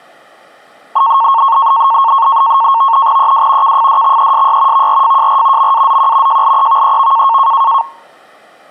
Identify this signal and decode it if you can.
NAVTEX (SITOR-B), 100 baud, 170 Hz shift, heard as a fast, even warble, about 1000 Hz centre. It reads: EW KFDXESY VRFJR MAZQ JLEVEV